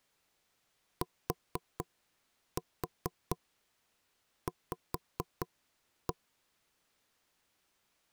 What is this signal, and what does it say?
Tap code, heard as knocks on wood, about 4 knocks a second. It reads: TV